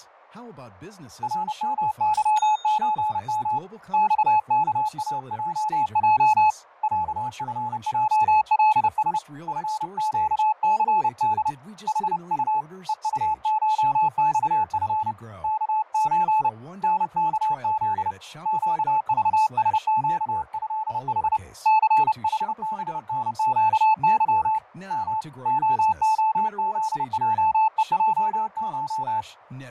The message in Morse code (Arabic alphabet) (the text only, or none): رمظزم صكاجج عفجلس فقثد حط ءطشصف كز نكذ قضسقهح ثحبنقظ م خخذجءجش